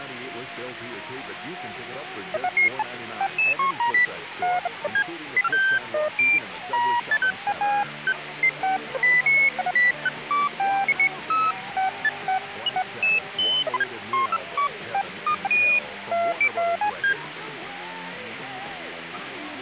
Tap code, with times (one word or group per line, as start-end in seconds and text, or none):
none